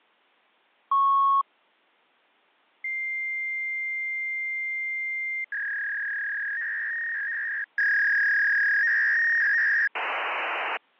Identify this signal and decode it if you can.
Fax machine handshake, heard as a beep, a long tone, a warble and hiss.